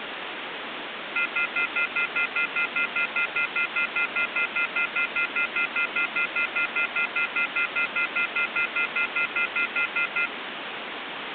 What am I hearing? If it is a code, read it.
Telephone call progress tone (North American plan), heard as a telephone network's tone, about 1400, 2050, 2450, 2600 Hz, 0.1 s on and 0.1 s off, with phone line noise. Off-hook warning tone.